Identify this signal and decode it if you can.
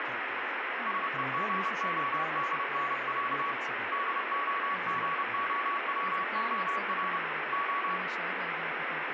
Morse code (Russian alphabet), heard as a keyed tone, hand-sent with a paddle, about 30 wpm, 1130 Hz, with radio static and speech in Hebrew. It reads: СЕГОДНЯ ДОГОВОР О